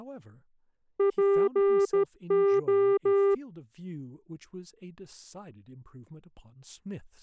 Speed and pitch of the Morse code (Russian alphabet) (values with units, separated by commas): 13 wpm, 400 Hz